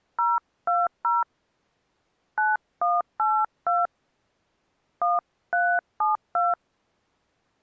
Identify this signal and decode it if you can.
DTMF, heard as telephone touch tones, dialled by hand, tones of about 200 ms. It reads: 020 9182 1372